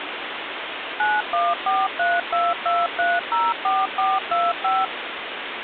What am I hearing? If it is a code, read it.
DTMF, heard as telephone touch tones, dialled by machine, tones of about 210 ms, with phone line noise. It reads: 914322304425